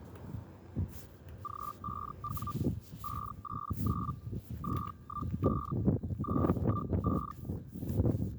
Hellschreiber (Feld-Hell, 122.5 baud), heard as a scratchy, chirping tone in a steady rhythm, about 1180 Hz, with the noise of a residential street. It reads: G5W 589 215 215